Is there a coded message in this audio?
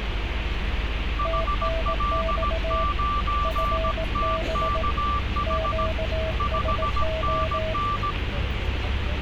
Yes: Morse code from 1.1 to 8.2 s, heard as two keyed tones, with radio static and street noise. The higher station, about 17 wpm, 1170 Hz: HL9TKH 5NN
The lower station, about 18 wpm, 650 Hz: TNX FB QSO